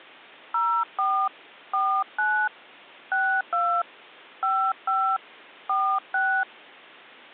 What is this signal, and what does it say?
DTMF, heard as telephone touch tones, dialled by hand, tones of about 290 ms. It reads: 04 49 62 55 46